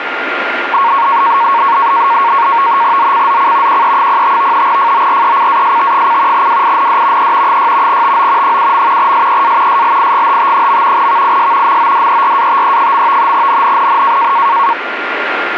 NAVTEX (SITOR-B), 100 baud, 170 Hz shift, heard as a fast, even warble, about 1010 Hz centre, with radio static and a steady whistle near 1410 Hz. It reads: ZCZC QE05 FORECAST: WIND E 6 TO 7. SEA SLIGHT. VIS MODERATE. NNNN